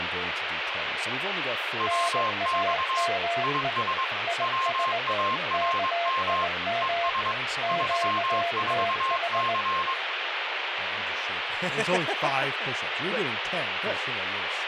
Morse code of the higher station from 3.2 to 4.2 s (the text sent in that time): IS